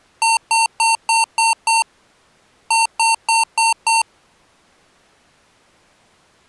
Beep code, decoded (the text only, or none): 6-5